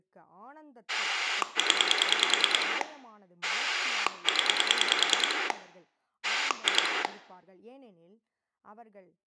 Pulse dialling, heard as a rotary dial, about 10 pulses a second, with room echo and speech in Tamil. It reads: 0 0 2